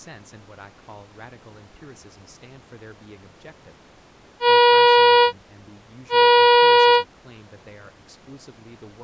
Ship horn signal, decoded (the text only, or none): 2 short